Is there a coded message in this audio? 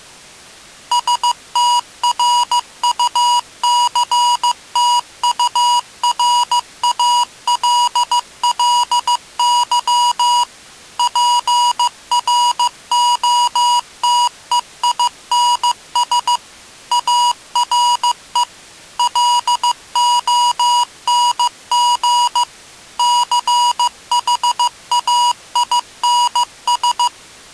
Yes: Morse code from 0.9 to 27.1 s, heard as electronic beeps, machine-sent, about 15 wpm, 970 Hz. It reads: STRUCTURALLY PROTEINS ARE LONG CHAINS